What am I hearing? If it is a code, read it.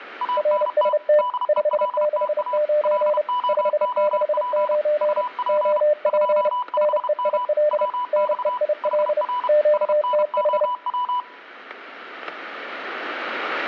Morse code, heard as two keyed tones, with static crashes. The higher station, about 32 wpm, 990 Hz: ANT DELTA LOOP UP 25M WX HR SNOW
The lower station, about 30 wpm, 600 Hz: RST 569 569 OP NEIL NEIL QTH